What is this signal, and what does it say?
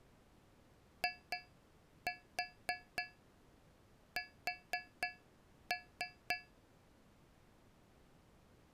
Tap code, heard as taps on a metal pipe, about 3 knocks a second. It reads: IS